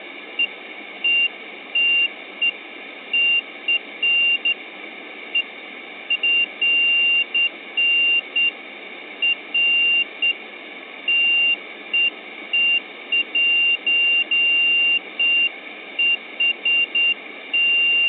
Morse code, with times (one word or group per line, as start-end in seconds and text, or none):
none